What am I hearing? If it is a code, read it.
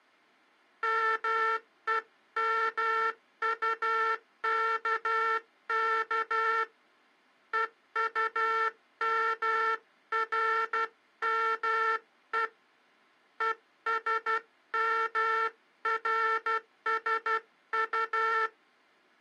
Morse code, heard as a buzzer, hand-sent with a paddle, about 12 wpm. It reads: MEMUKK EUMRME ESMRSU